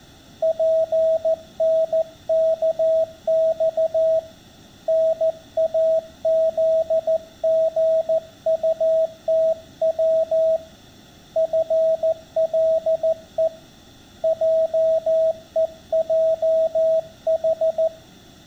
Morse code, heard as a keyed tone, hand-sent with a paddle, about 14 wpm, 650 Hz. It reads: PNKX NAZGUTW FLE JEJH